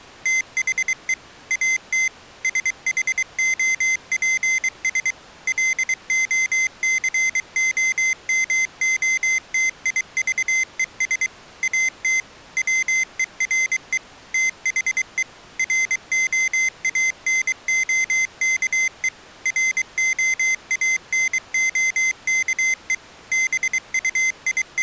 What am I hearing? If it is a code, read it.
Morse code, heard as a high beeper, machine-sent, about 23 wpm, 2050 Hz. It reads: THE AT SHOPS LOCOMOTIVES AT WERE THE ROANOKE ROANOKE …